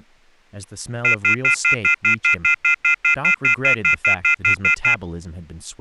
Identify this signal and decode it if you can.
Telephone call progress tone (North American plan), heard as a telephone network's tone, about 1400, 2050, 2450, 2600 Hz, 0.1 s on and 0.1 s off, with speech in English. Off-hook warning tone.